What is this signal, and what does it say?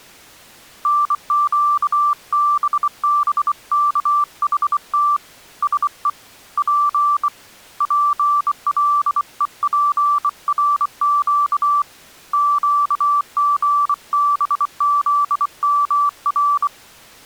Morse code, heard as a keyed tone, hand-sent with a bug key, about 24 wpm, 1170 Hz. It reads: NQBBKHT SE P PLEPRQ QGBZMR